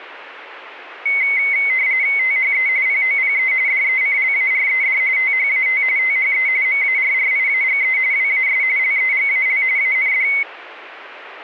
RTTY (45.45 baud, 170 Hz shift), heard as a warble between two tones, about 2150 Hz centre. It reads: THE POPE DECLARED THAT THE MARRIAGE WAS LEGAL AND